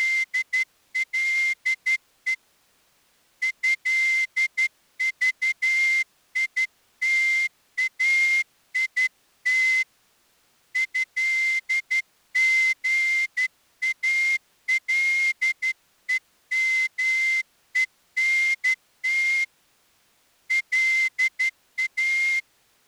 Morse code (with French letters), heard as a whistle, hand-sent with a straight key, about 12 wpm. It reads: … ÉVITAIT ÉGALEMENT LA